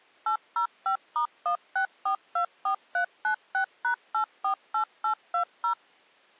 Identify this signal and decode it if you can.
DTMF, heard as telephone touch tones, dialled by machine, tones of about 100 ms. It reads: 805*16424396#848820